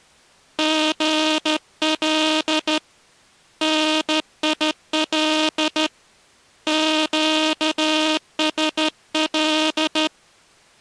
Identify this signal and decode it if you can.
Morse code, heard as a buzzer, hand-sent with a straight key, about 13 wpm. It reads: GL NIL QSL